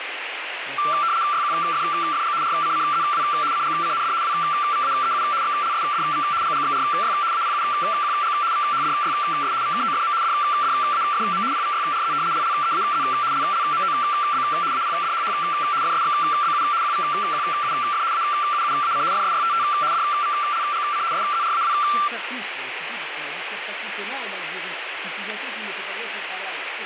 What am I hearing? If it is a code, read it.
RTTY (75 baud, 170 Hz shift), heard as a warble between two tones, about 1260 Hz centre, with radio static and speech in French. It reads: YQFFG RCCZW CGCND WVAEU XLSDV GGXRY APUQG VHDYS VKOFM DDAFM PVYRZ LLEAZ LLMOB APDHH FSXBU QVQUF AUUAC FSYTT DVLGC SZRAW